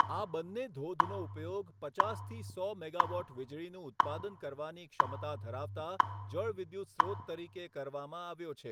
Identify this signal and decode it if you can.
Radio time signal (WWV, Colorado), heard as ticks, one a second, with room echo and speech in Gujarati.